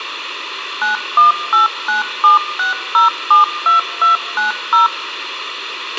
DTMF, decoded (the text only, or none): 918976072290